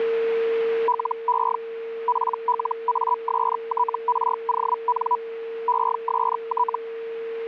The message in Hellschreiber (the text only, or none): LE PLASTRON EST